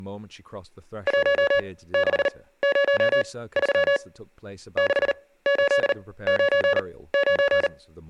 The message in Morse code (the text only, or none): 1603 6899